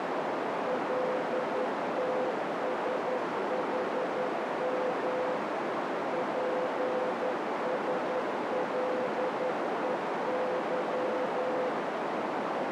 Morse code, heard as a keyed tone, machine-sent, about 11 wpm, 510 Hz, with heavy radio static and a narrow filter. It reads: LTSHM PSLEY